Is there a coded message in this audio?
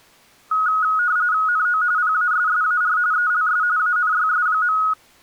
Yes: RTTY (45.45 baud, 170 Hz shift) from 0.5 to 4.9 s, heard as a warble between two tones, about 1360 Hz centre. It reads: NO PASSAR ELS ANYS.